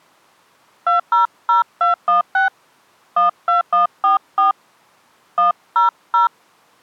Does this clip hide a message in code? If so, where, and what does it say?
Yes: DTMF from 0.9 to 6.3 s, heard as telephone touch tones, dialled by hand, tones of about 130 ms. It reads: 200216 12144 100